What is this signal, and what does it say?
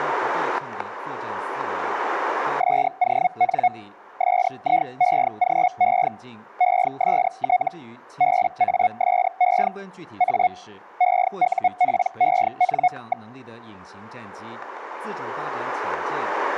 Hellschreiber (Feld-Hell, 122.5 baud), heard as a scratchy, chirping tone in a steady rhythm, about 730 Hz, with static crashes. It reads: SON SIEGE EST BASE A EUPEN.